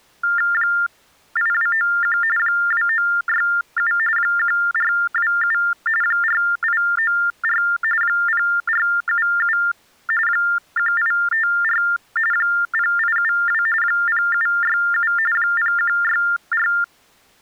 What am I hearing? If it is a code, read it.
TTY/TDD text telephone tones (45.45 baud Baudot), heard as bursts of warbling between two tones, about 400 Hz shift, 1600 Hz centre. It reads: 8291 2967 1427 4894 0477 1854 0872 0767 0164